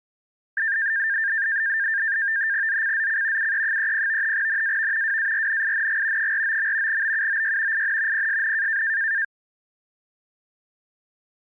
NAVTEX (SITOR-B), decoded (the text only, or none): ZCZC UE30 NAV WARNING 49. BUOY IN PSN